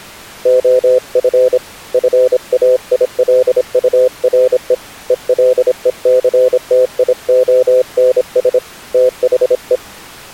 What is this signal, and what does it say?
Morse code, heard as a keyed tone, hand-sent with a paddle, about 26 wpm, 510 Hz. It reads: OF FAILURE ELECTIONS THE